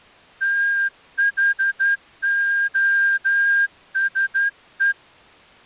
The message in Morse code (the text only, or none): THOSE